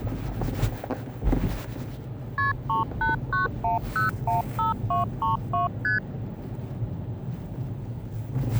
Multi-frequency trunk signalling (R1, as on North American trunks), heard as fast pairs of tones, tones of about 140 ms, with the noise inside a car. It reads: KP 3891015232 ST